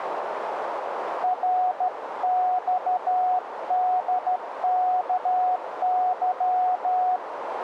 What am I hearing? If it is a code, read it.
Morse code, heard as a keyed tone, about 13 wpm, 730 Hz, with radio static and a narrow filter. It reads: RXDKY